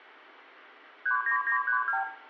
Multi-frequency trunk signalling (R2, with the far end's replies), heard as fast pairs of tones, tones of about 100 ms, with room echo. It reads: 39932